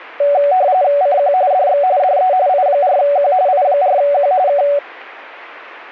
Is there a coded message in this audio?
Yes: RTTY (45.45 baud, 170 Hz shift) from 0.2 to 4.8 s, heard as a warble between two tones, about 660 Hz centre. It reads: CQ DX DE I4Q I4Q K